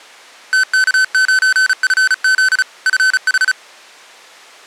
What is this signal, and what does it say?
Morse code, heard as electronic beeps, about 35 wpm, 1500 Hz. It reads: TK9FZ FH